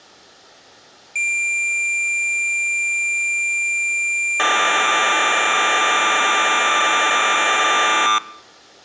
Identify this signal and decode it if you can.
Cassette data (Kansas City type), 1200 baud, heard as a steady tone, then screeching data.